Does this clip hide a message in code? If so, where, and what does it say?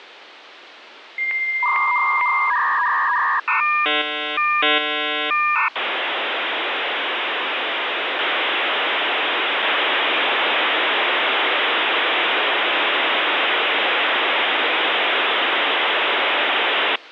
Yes: dial-up modem handshake (V.34 or later) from 1.2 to 17.0 s, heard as a whistle, warbles, then hiss, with phone line noise.